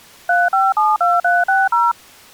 DTMF, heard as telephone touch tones, dialled by machine, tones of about 200 ms. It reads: 3572360